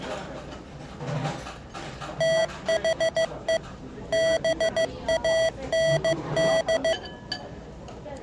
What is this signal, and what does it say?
Morse code, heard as electronic beeps, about 15 wpm, 650 Hz, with the noise of a restaurant. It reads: THE BAND